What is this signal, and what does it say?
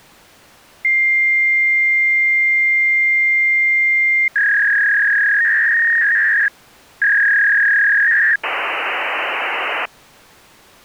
Fax machine handshake, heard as a long tone, a warble and hiss.